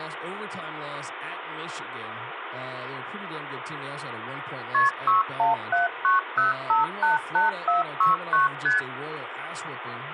Multi-frequency trunk signalling (R1, as on North American trunks), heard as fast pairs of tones, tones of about 150 ms, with phone line noise and speech in English. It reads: KP 61790588469 ST